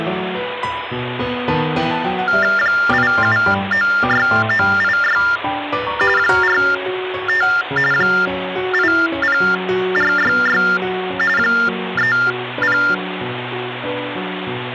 TTY/TDD text telephone tones (45.45 baud Baudot), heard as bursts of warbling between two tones, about 400 Hz shift, 1600 Hz centre, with phone line noise. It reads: 8796986 45 80466 30